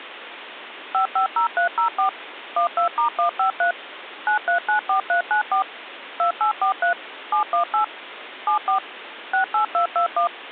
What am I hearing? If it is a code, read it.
DTMF, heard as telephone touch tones, dialled by machine, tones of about 110 ms, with phone line noise. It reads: 550304 12*153 9394394 2843 718 74 68221